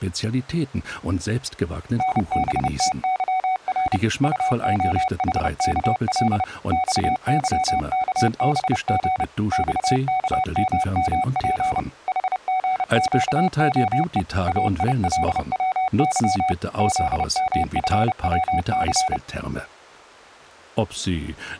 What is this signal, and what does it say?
Morse code, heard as a keyed tone, machine-sent, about 30 wpm, 750 Hz. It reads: NBTYR UOHKL XYKBG XKMMP HGQOE AILWY ZMFWC